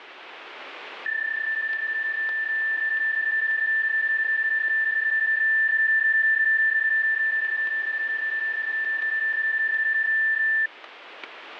PSK31 (31.25 baud), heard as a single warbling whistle, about 1750 Hz.